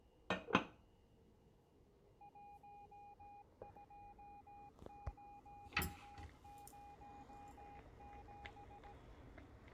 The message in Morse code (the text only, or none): 12007